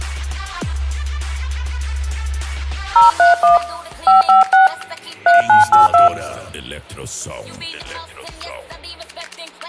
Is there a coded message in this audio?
Yes: DTMF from 3.0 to 6.1 s, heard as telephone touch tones, dialled by hand, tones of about 140 ms, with hum. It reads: 031 556 3982